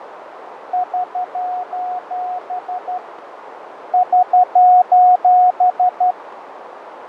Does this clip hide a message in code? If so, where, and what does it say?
Yes: Morse code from 0.7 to 6.2 s, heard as a keyed tone, hand-sent with a straight key, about 12 wpm, 730 Hz, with radio static, fading and a narrow filter. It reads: <SOS> <SOS>